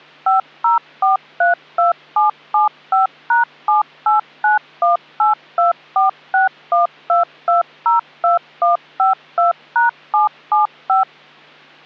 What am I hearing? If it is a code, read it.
DTMF, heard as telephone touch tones, dialled by machine, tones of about 140 ms. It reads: 50432775#7891824612202152#775